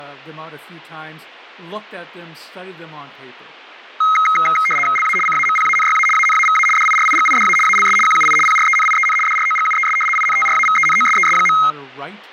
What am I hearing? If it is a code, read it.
RTTY (75 baud, 850 Hz shift), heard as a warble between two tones, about 1700 Hz centre, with speech in English. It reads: LA CAMPANYA ANAVA DIRIGIDA ALS QUI PRENIEN DROGUES INTRAVENOSES.